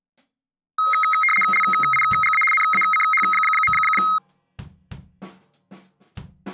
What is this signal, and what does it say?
RTTY (75 baud, 850 Hz shift), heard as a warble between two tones, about 1700 Hz centre. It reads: LIGA NACH.